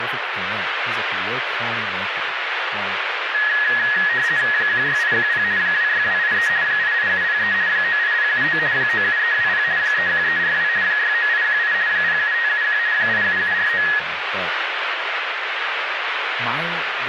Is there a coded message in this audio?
Yes: RTTY (50 baud, 170 Hz shift) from 3.3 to 14.0 s, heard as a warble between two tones, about 1800 Hz centre, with radio static and speech in English. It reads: 16810 26283 88703 98079 97320 31342 69818 07571 87749